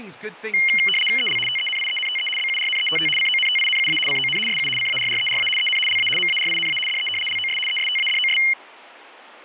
RTTY (75 baud, 850 Hz shift), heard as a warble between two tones, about 2550 Hz centre, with speech in English. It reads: EL TENIENTE BURNETT CONTINUA CON SU CARRERA EN LA MARINA DE LOS ESTADOS